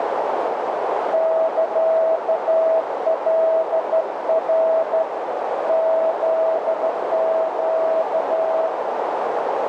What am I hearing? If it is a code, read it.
Morse code (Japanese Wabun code), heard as a keyed tone, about 13 wpm, 650 Hz, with heavy radio static and a narrow filter. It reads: サカナ フネ